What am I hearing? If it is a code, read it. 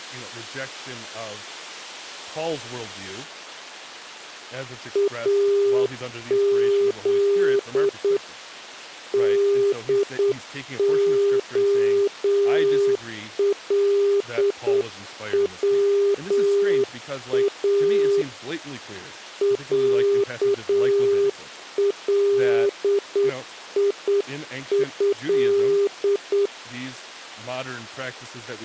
Morse code (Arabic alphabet), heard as a keyed tone, hand-sent with a straight key, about 8 wpm, 400 Hz, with speech in English. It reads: اذ دخلوا عليه